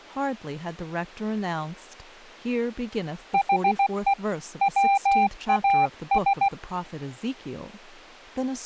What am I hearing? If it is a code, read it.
Morse code, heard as a keyed tone, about 16 wpm, 790 Hz, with speech in English. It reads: HE WAS